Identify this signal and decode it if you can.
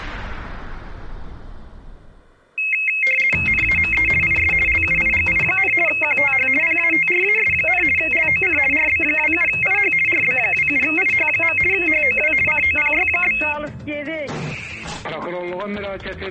RTTY (50 baud, 450 Hz shift), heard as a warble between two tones, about 2350 Hz centre. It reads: NAME IS LUIGI, QTH PATRAS, LOC RB27IH RB27IH. HOW COPY?